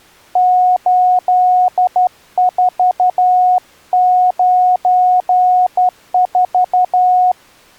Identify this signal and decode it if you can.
Morse code, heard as a keyed tone, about 12 wpm, 730 Hz. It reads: 8494